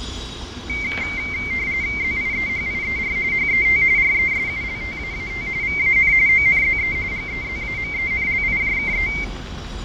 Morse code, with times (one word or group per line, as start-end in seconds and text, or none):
none